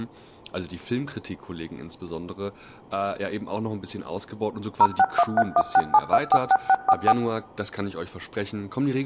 DTMF, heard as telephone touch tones, dialled by machine, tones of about 50 ms, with speech in German. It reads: 0613167246644